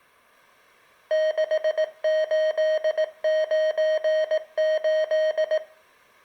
Morse code, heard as electronic beeps, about 18 wpm, 620 Hz, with room echo. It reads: 6898